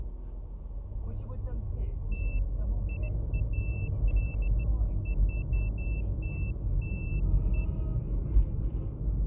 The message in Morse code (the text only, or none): none